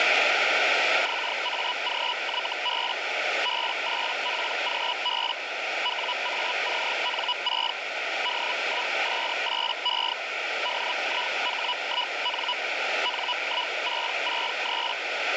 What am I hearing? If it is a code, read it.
Hellschreiber (Feld-Hell, 122.5 baud), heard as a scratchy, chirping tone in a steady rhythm, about 980 Hz, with radio static and a narrow filter. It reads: XAGYB B8PGB WACN6 D1S8E DIH1N N1663